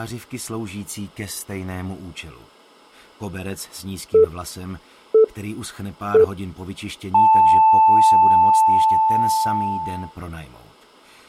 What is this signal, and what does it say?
Radio time signal (three low pips and a long one an octave up, as on NHK), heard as pips.